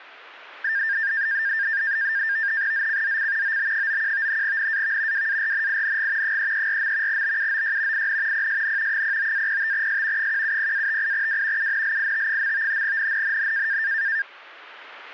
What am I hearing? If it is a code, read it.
NAVTEX (SITOR-B), 100 baud, 170 Hz shift, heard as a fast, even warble, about 1700 Hz centre. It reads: ZCZC OB91 NAV WARNING 334. BUOY IN PSN 09-05S 170-58W UNLIT. NNNN